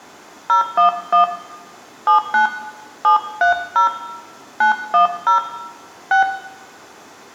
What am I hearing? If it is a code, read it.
DTMF, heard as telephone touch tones, dialled by hand, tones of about 120 ms, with room echo. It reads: 011 79 730 910 6